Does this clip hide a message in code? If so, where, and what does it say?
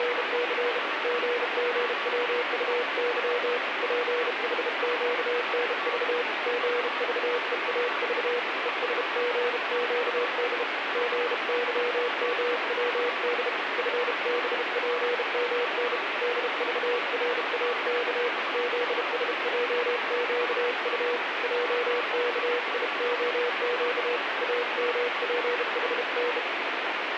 Yes: Morse code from 0.0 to 26.5 s, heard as a keyed tone, hand-sent with a bug key, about 32 wpm, 480 Hz, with heavy radio static. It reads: … GGWUY PHQNV GVEAV ESGQD GYMWD FBPMN DVRAK ZSJQU JKIOQ AMPHN